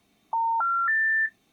Telephone call progress tone (North American plan), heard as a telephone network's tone, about 910, 1370, 1800 Hz. Special information tone.